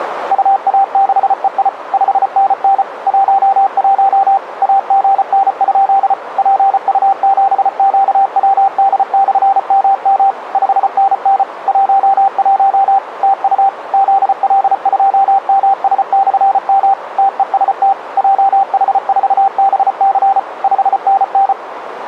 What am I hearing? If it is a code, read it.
Morse code, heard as a keyed tone, machine-sent, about 34 wpm, 780 Hz, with radio static. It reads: UA6EI 5NN 11 AGN? PU7QWD/MM 5NN 11 TU ZL2MS/M TEST JH4BC 5NN